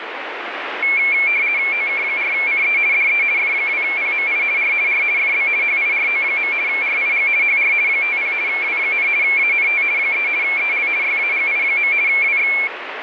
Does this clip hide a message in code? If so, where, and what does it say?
Yes: RTTY (50 baud, 170 Hz shift) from 0.8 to 12.7 s, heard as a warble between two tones, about 2250 Hz centre, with radio static. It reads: OK4CE DE F2PMI R R FB HIRO. RIG HR 50 W, ANT 3 EL YAGI. WX